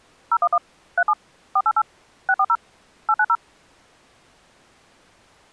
DTMF, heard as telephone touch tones, dialled by machine, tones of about 60 ms. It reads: 011 37 488 640 890